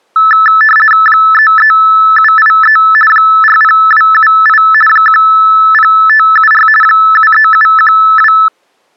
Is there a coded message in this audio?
Yes: RTTY (50 baud, 450 Hz shift) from 0.2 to 8.5 s, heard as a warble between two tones, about 1550 Hz centre. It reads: 33783 40278 10574 73712